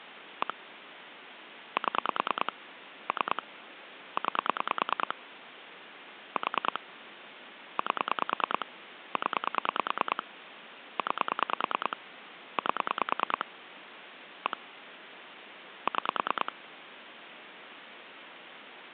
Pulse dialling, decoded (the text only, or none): 1 7 3 9 4 8 0 9 8 1 6